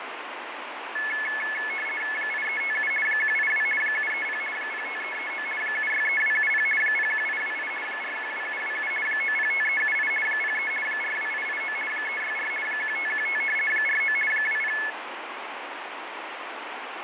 RTTY (50 baud, 450 Hz shift), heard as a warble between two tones, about 1950 Hz centre, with radio static and fading. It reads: 8357 182 730 05339 763270 01828 412727 905378 03 42889 364 1515 49 20